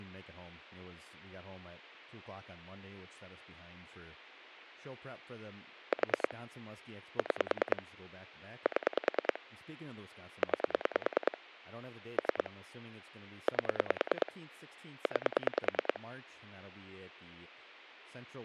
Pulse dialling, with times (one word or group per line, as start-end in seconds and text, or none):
5.9-6.3 4
7.2-7.8 6
8.7-9.4 7
10.4-11.4 9
12.2-12.5 3
13.5-14.3 8
15.1-16.0 9